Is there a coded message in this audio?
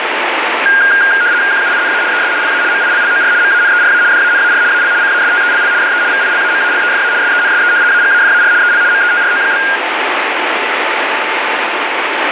Yes: RTTY (75 baud, 170 Hz shift) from 0.7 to 9.8 s, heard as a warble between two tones, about 1500 Hz centre, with radio static. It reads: QUINA ES LA MILLOR MANERA DANAR AL CASTELL DE VILAMALEFA SENSE AGAFAR EL METRO?